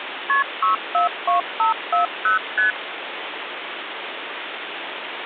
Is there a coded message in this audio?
Yes: multi-frequency trunk signalling (R1, as on North American trunks) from 0.3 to 2.7 s, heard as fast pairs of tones, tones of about 130 ms, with phone line noise. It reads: KP 642540 ST